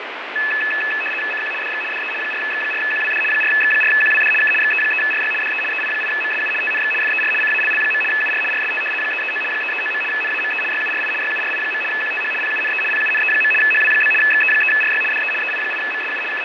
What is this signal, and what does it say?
RTTY (75 baud, 850 Hz shift), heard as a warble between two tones, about 2150 Hz centre, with radio static and fading. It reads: CQ DX DE 4X4QWD 4X4QWD K XE3RY DE EI8MSU TNX FER CALL. UR RST 339 339. NAME YURI YURI. QTH PUNE PUNE. HW? XE3RY DE EI8MSU …